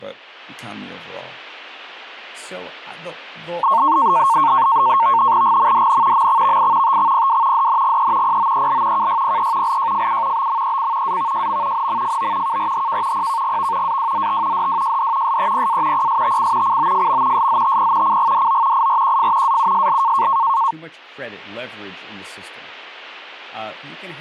NAVTEX (SITOR-B), 100 baud, 170 Hz shift, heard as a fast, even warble, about 1000 Hz centre, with speech in English. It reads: GMDN MXVI TXPW DNGE POEL KYPE LJFU BMEC AVJM NMFO KRHK PKGV AWZT DWJD SEPA PSTC COFM SZTP CGDO IRQF AUSL